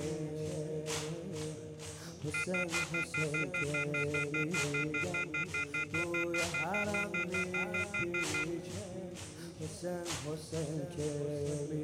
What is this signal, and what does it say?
Telephone call progress tone (North American plan), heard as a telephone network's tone, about 1400, 2050, 2450, 2600 Hz, 0.1 s on and 0.1 s off. Off-hook warning tone.